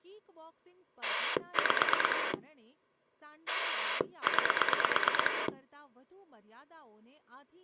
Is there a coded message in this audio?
Yes: pulse dialling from 1.0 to 5.5 s, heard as a rotary dial, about 9 pulses a second, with speech in Gujarati. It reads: 5 9